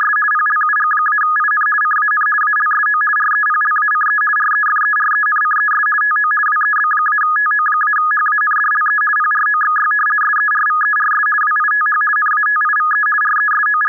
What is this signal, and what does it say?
RTTY (50 baud, 450 Hz shift), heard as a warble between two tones, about 1460 Hz centre. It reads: … PLUG-IN CAN ALSO REPLACE REFERENCES TO WEB-TO-HANDLE PROXY SERVERS WITH NATIVE …